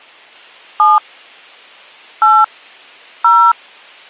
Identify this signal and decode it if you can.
DTMF, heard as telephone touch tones, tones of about 200 ms. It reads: 7 8 0